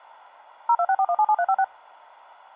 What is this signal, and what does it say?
DTMF, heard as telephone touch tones, dialled by machine, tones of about 60 ms. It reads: 0264177356